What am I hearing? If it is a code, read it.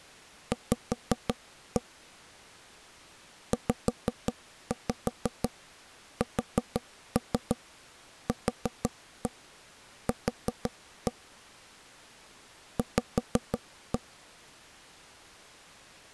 Tap code, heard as knocks on wood, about 6 knocks a second. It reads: V ZSQQ V